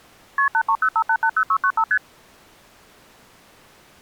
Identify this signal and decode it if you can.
Multi-frequency trunk signalling (R1, as on North American trunks), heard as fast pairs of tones, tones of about 70 ms. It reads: KP 8305880695 ST